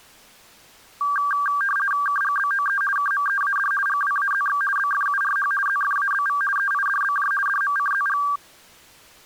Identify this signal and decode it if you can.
RTTY (50 baud, 450 Hz shift), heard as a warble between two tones, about 1370 Hz centre. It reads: KGBOE KMEAD GWAZX BFURH ZFABV EIDBJ DMCZG